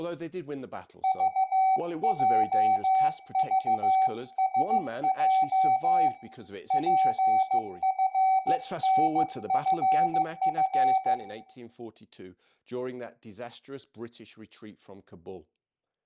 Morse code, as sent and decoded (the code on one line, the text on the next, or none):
...- .--- ...- ... .--- / .--. ..-. -. ..-. ..-.
VJVSJ PFNFF